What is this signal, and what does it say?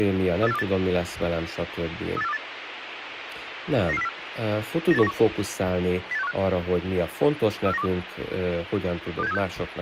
Five-tone selective call (EEA), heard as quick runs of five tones, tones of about 40 ms, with radio hiss and speech in Hungarian. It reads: 38428 38428 99404 98191 08615 34912 26736